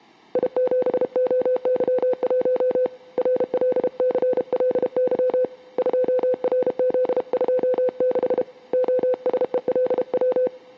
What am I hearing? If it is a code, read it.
Morse code, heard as a keyed tone, hand-sent with a paddle, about 32 wpm, 510 Hz. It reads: I7OY1 RLCLY 2RZ26 OSELW